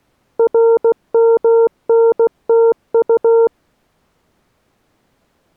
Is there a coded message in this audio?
Yes: Morse code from 0.3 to 3.5 s, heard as a keyed tone, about 16 wpm, 460 Hz. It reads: RMNTU